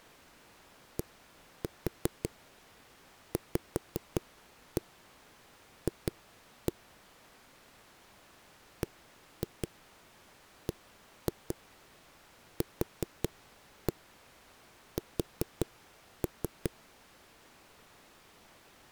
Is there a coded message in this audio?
Yes: tap code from 1.0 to 16.7 s, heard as knocks on a wall, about 5 knocks a second. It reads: DVF BBQS